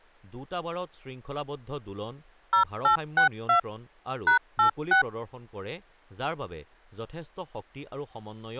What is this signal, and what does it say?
DTMF, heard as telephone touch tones, dialled by machine, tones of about 110 ms, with speech in Assamese. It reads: 0862 #86